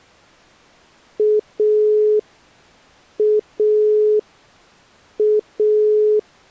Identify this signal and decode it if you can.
Telephone call progress tone (pulsed, as in Italy), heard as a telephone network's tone, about 420 Hz. Dial tone.